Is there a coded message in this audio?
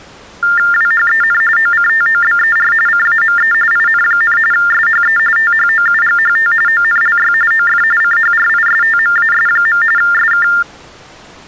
Yes: TTY/TDD text telephone tones (45.45 baud Baudot) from 0.4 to 10.6 s, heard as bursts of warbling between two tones, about 400 Hz shift, 1600 Hz centre. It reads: WHEN OCTOBER CAME IN, SHE THOUGHT ONLY OF CHRISTMAS. SK